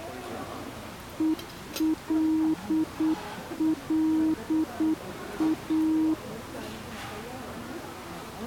Morse code, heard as a keyed tone, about 8 wpm, 320 Hz, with the noise of a crowd indoors. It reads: ELLA